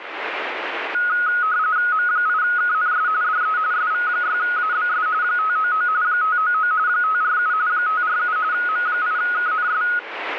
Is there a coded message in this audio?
Yes: RTTY (45.45 baud, 170 Hz shift) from 0.9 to 10.0 s, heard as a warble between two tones, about 1360 Hz centre, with radio static. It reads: M8KNS DE SV6ABS 599 599 547 547 M8KNS